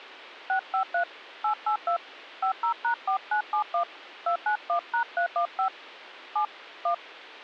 DTMF, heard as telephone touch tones, dialled by hand, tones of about 100 ms. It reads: 653 882 50#4971 291#315 7 1